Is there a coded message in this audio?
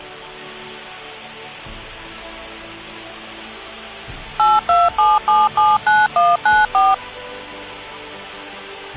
Yes: DTMF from 4.4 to 6.9 s, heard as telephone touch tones, dialled by machine, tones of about 200 ms. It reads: 827779194